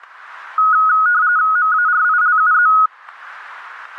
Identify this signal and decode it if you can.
RTTY (45.45 baud, 170 Hz shift), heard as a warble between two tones, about 1360 Hz centre, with static crashes. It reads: MARILUZ